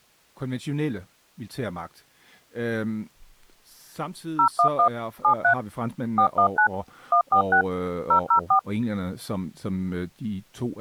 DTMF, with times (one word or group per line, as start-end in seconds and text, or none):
4.4-4.9 011
5.2-5.5 73
6.2-6.7 419
7.1-7.6 146
8.1-8.6 004